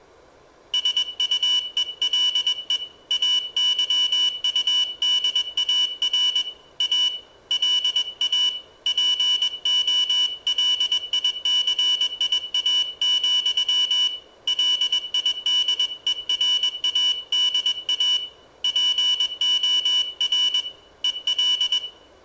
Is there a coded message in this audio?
Yes: Morse code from 0.7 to 21.8 s, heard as a high beeper, hand-sent with a paddle, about 21 wpm, 2950 Hz, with room echo. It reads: SUELE AYUDAR A LA POLICIA, LIDERADA POR EL